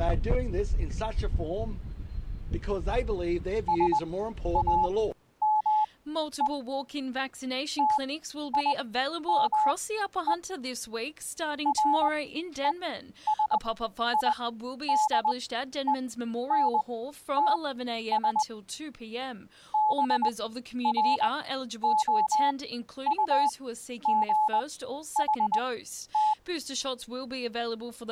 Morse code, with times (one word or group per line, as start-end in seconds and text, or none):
3.7-6.5 SAME
7.8-10.3 TIME
11.7-18.4 RESIDENTS
19.7-26.3 BROUGHT